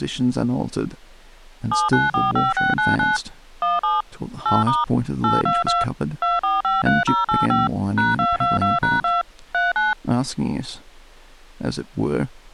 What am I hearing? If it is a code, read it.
DTMF, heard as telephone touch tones, dialled by machine, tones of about 170 ms, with speech in English. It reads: 7945699 17 8* 822 2453085 #222#2 39